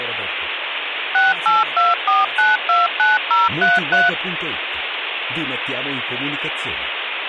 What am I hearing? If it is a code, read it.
DTMF, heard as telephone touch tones, dialled by machine, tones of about 180 ms, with phone line noise and speech in Italian. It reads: 6824929033